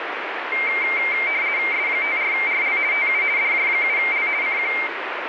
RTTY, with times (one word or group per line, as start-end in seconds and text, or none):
1.7-2.8 S54RL
2.9-3.2 TU
3.4-4.3 DJ7L
4.4-4.7 CQ